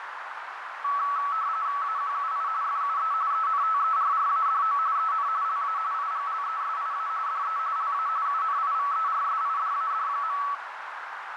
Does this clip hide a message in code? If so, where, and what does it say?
Yes: RTTY (45.45 baud, 170 Hz shift) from 0.8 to 10.5 s, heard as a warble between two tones, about 1220 Hz centre, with radio static and a narrow filter. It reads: AQUI FUE ENTERRADO EN LA IGLESIA DE LA UNIVERSIDAD.